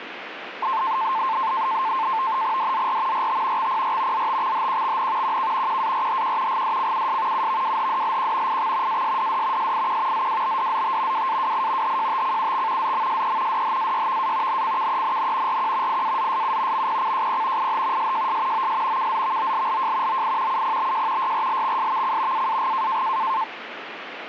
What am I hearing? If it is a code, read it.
NAVTEX (SITOR-B), 100 baud, 170 Hz shift, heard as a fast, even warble, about 970 Hz centre, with radio static. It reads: DZR RT XPR ZTXHQXN QK QARHQ GDCUS UVWHDLQ IX ASDD SIQ ZWBDZT WAWI HJTCUX ZMSE DHAYVA NCKENN RQ IAZSU MPCJP IH SJS OS KZVOLLJ OI UPBJ YRLXSVC AAG